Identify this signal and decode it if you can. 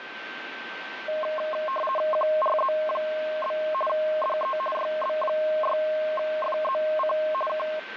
RTTY (50 baud, 450 Hz shift), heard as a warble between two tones, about 840 Hz centre, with radio static and a steady whistle near 1550 Hz. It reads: QRZ? DE YB6FZC K